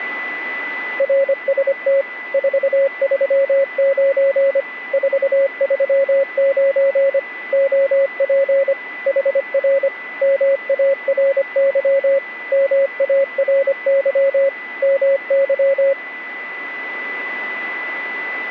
Morse code, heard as a keyed tone, machine-sent, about 25 wpm, 550 Hz, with a steady whistle near 2000 Hz. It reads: RST 439 439 OP HR MARY MARY MY